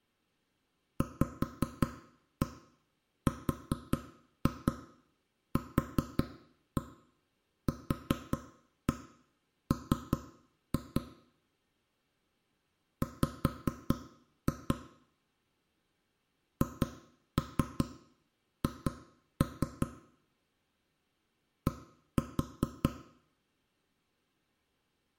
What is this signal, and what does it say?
Tap code, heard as knocks on wood, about 5 knocks a second, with room echo. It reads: VRQQM W HH D